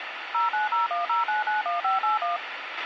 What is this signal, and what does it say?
DTMF, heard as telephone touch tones, dialled by machine, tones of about 140 ms, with radio hiss and a squelch burst at the end. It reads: 09010991581